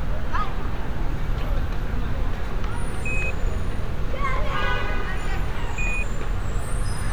Quindar tones, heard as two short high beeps, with street noise.